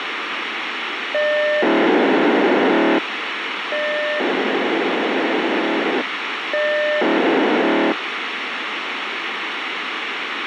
POCSAG pager data (1200 baud), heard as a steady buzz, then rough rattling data, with radio hiss.